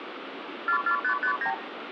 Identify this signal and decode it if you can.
Multi-frequency trunk signalling (R2, with the far end's replies), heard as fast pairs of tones, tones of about 90 ms, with phone line noise. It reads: 44559